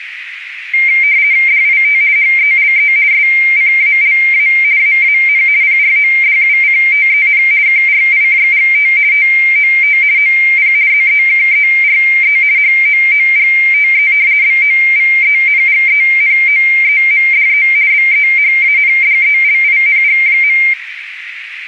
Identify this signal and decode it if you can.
RTTY (50 baud, 170 Hz shift), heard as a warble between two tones, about 2200 Hz centre, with radio static and a narrow filter. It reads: DIT HELE SCALA AAN PRODUCTEN KRIJGT TOT OP ZEKERE HOOGTE BOVENGENOEMDE BEHANDELING.